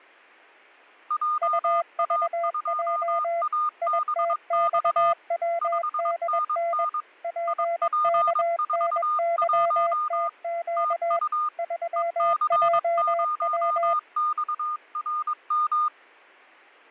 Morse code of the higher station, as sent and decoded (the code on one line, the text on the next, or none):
.--- .- ..--- .- -... -..- / ..... -. -. / .. .--. ....- .---- / - ..- / . -.-. ----- -..- .-. --
JA2ABX 5NN IP41 TU EC0XRM